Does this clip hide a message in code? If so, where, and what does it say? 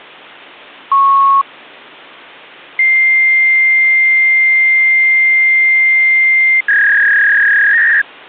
Yes: fax machine handshake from 0.9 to 8.0 s, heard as a beep, a long tone and a warble.